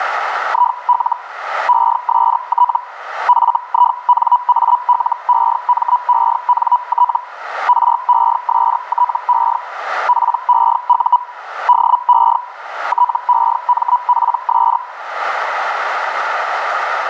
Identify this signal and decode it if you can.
Hellschreiber (Feld-Hell, 122.5 baud), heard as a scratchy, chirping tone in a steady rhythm, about 980 Hz. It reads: IL EST FINALEMENT RESTE PEU DE TEMPS